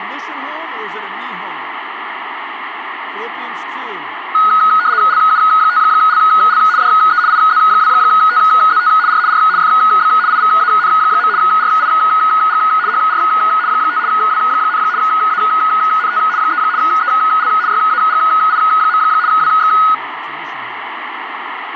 RTTY (75 baud, 170 Hz shift), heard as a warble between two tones, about 1360 Hz centre, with radio static and speech in English. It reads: LU5LL DE IZ2TZT R R FB IVAN. RIG HR 5 W, ANT 3 EL YAGI. WX